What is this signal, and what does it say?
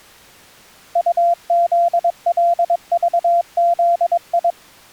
Morse code, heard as a keyed tone, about 22 wpm, 690 Hz. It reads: UZLVZI